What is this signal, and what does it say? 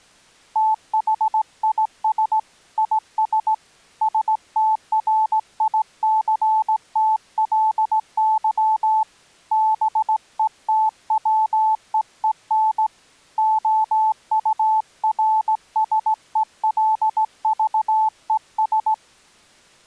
Morse code, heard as a keyed tone, hand-sent with a straight key, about 17 wpm, 870 Hz. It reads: THIS IS STRICTLY BETWEEN OURSELVES